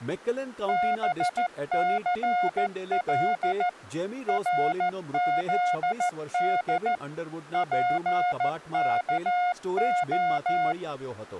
Morse code (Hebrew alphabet), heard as a keyed tone, machine-sent, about 14 wpm, 720 Hz, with speech in Gujarati. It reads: בסל רזד פכה